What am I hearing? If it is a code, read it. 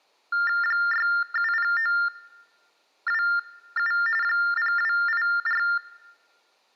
TTY/TDD text telephone tones (45.45 baud Baudot), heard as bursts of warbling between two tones, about 400 Hz shift, 1600 Hz centre. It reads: 670927 0284